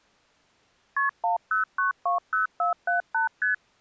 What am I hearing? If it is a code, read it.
Multi-frequency trunk signalling (R1, as on North American trunks), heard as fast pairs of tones, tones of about 130 ms. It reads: KP 10920478 ST